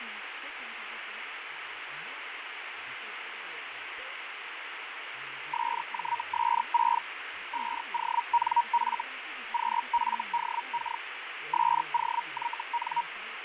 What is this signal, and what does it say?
Hellschreiber (Feld-Hell, 122.5 baud), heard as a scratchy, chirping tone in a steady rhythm, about 940 Hz, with radio static and fading. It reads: SJS6 5ONF QFDK SOYN